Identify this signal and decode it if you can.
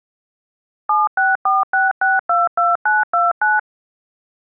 DTMF, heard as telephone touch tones, dialled by machine, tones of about 180 ms. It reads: 7646622929